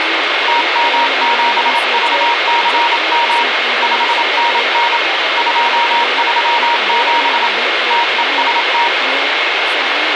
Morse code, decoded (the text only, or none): TM7VCM 5NN 237 TEST